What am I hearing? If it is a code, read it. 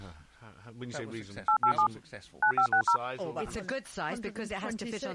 DTMF, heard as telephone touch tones, dialled by machine, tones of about 90 ms. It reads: 887 9560